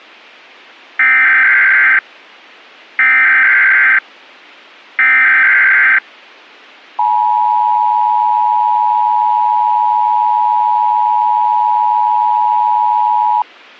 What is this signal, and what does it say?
Emergency Alert System (SAME) tones (header bursts, then the 853 and 960 Hz attention tone), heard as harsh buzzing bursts, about 520.83 baud.